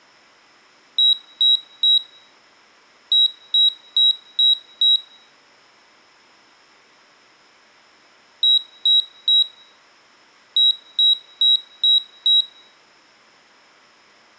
Beep code, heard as a piezo beeper, played twice, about 3850 Hz. 3-5.